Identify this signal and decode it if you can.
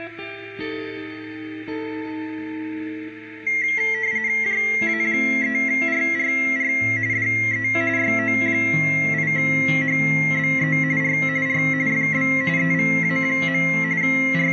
RTTY (45.45 baud, 170 Hz shift), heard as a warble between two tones, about 2050 Hz centre, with radio static. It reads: JA3RRR DE YO8HBE R R FB EVA. …